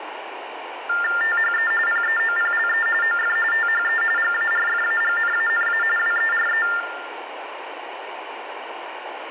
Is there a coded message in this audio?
Yes: TTY/TDD text telephone tones (45.45 baud Baudot) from 0.9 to 6.8 s, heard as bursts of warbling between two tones, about 400 Hz shift, 1600 Hz centre, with phone line noise and room echo. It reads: THE PEOPLE OF THE GARFAGNANA WERE